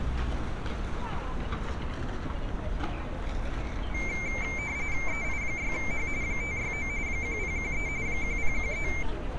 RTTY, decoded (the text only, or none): EI6H 569 1013 1013